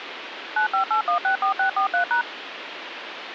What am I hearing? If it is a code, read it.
DTMF, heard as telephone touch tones, dialled by machine, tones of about 100 ms, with phone line noise. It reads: 958164643#